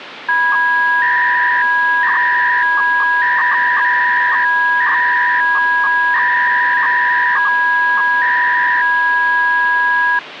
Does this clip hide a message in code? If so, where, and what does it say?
Yes: 300-baud modem data (V.21 tones) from 0.3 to 10.2 s, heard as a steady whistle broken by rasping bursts, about 300 baud, 200 Hz shift, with phone line noise.